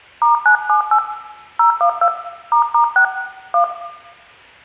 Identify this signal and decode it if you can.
DTMF, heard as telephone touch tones, dialled by hand, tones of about 100 ms, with room echo. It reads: *978 012 **6 1